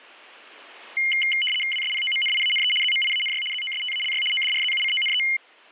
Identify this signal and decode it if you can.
RTTY (75 baud, 850 Hz shift), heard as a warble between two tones, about 2550 Hz centre. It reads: WSPOMNIANE ZMIANY ZOSTALY ODRZUCONE